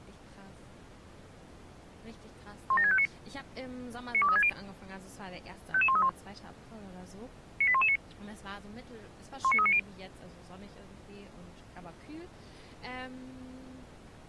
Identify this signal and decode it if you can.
Five-tone selective call (ZVEI), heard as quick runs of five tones, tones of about 70 ms, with speech in German. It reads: 17659 92360 55131 98119 19390